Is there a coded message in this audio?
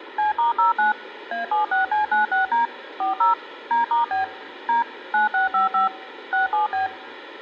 Yes: DTMF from 0.2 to 6.9 s, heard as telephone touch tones, dialled by machine, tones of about 140 ms. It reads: C*09 A76C96D 40 D*B D 9655 67B